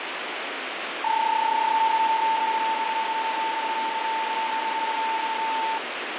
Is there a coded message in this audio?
Yes: PSK31 (31.25 baud) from 1.0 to 5.8 s, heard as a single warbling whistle, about 890 Hz, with radio static.